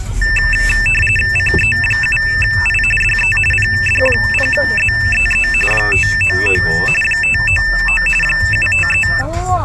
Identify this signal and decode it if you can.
RTTY (45.45 baud, 850 Hz shift), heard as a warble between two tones, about 2200 Hz centre, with the noise inside a car. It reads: CE7I DE PD0ZEE 599 599 753